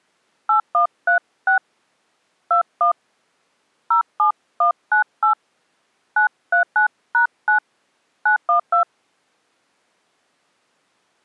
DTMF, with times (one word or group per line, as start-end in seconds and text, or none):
0.5-1.6 8136
2.5-2.9 21
3.9-5.3 07198
6.2-7.6 939#9
8.3-8.8 912